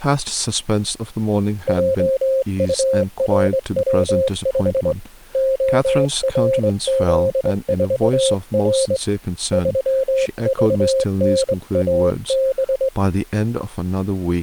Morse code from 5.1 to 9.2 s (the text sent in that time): ORZ4R